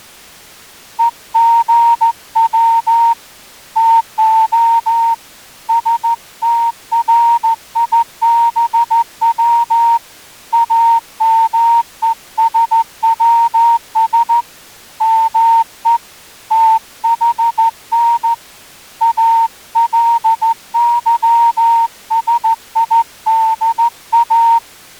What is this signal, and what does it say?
Morse code (Greek alphabet), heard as a whistle, hand-sent with a straight key, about 14 wpm. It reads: ΕΓΩ ΤΟ ΣΤΡΙΒΩ ΑΜΕΣΩΣ ΜΕ ΤΗΝ ΑΛΥΣΙΔΑ